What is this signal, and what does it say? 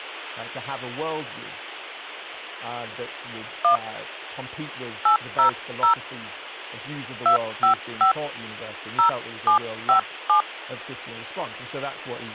DTMF, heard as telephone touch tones, dialled by hand, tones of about 110 ms, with speech in English. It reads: 1 800 255 0757